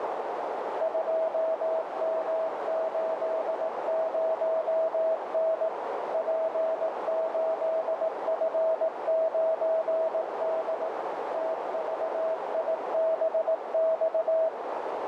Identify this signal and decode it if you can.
Morse code, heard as a keyed tone, machine-sent, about 18 wpm, 650 Hz, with heavy radio static and a narrow filter. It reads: 2M80N P8F9D TVIBX